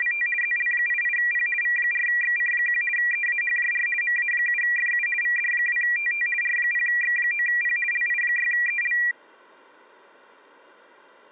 RTTY (50 baud, 450 Hz shift), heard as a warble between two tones, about 2150 Hz centre. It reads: … ZL88P V4XC1 EAHJR MA7FU VD2TT R0X9P LI6EL